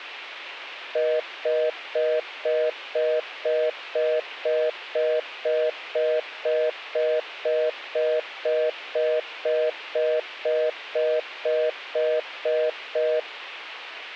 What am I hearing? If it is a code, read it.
Telephone call progress tone (North American plan), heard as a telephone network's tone, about 480, 620 Hz, 0.25 s on and 0.25 s off. Congestion tone.